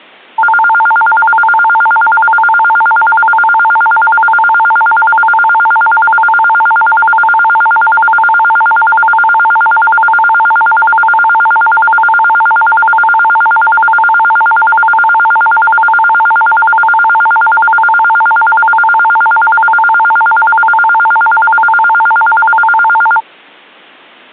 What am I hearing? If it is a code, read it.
A tone that alternates evenly between two pitches. There is no code.